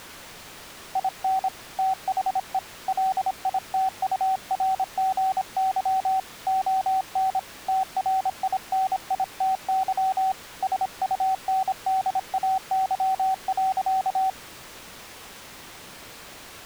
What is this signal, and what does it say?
Morse code, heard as a keyed tone, hand-sent with a paddle, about 26 wpm, 760 Hz. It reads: IN THE LITURGY ON TRINITY SUNDAY.